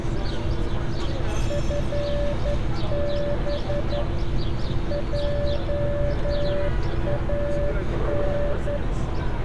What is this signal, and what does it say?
Morse code, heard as a keyed tone, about 11 wpm, 580 Hz, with radio static and street noise. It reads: FB JAN